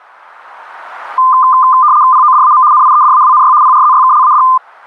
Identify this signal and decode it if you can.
RTTY (75 baud, 170 Hz shift), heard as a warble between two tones, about 1120 Hz centre. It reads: PODAM NIEDAWNY PRZYKLAD